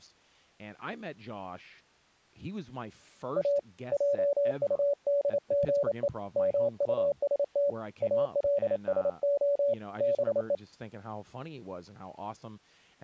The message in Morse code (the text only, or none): A JUDGE MUST ALSO BE